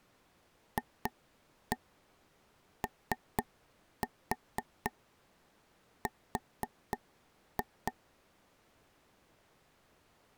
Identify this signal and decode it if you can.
Tap code, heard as taps on a table, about 4 knocks a second. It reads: FOR